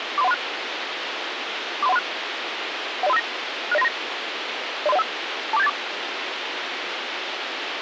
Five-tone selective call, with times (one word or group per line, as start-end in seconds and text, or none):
0.2-0.3 43136
1.8-2.0 43136
3.0-3.2 10359
3.7-3.9 60939
4.9-5.0 03015
5.5-5.7 24784